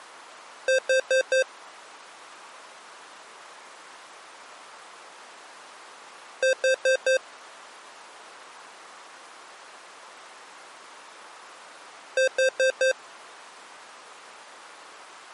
Alarm pattern, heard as an alarm's beeps, played three times, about 520 Hz. Temporal four. Carbon monoxide.